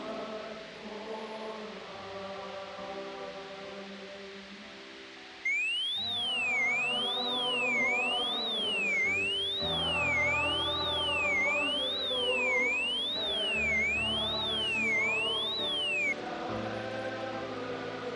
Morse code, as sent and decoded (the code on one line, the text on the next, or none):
none